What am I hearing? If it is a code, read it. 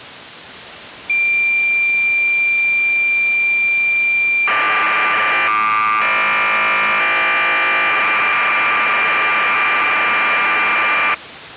Cassette data (Kansas City type), 1200 baud, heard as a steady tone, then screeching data.